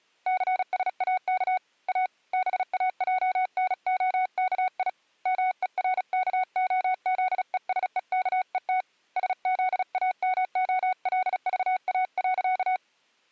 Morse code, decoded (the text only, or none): CSAK A BAJNOKI MERKOZESEKET SZAMOLVA.